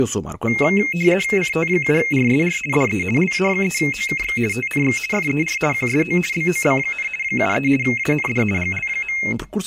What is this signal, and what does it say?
RTTY (50 baud, 450 Hz shift), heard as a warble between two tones, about 2350 Hz centre, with speech in Portuguese. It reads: CT7RSR DE LA3OKX TNX FER QSO BOB, 73 AND GL.